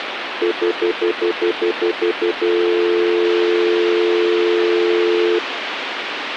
Telephone call progress tone (North American plan), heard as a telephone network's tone, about 350, 440 Hz, 0.1 s on and 0.1 s off, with phone line noise. Stutter dial tone.